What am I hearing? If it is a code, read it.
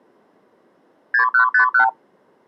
Multi-frequency trunk signalling (R2, with the far end's replies), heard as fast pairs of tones, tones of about 100 ms. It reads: 6151